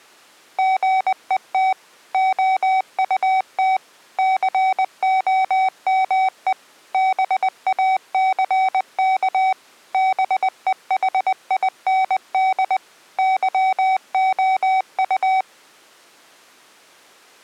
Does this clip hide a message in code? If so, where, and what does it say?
Yes: Morse code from 0.5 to 15.5 s, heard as electronic beeps, machine-sent, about 20 wpm, 760 Hz. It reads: GET OUT COME BACK BEHIND YOU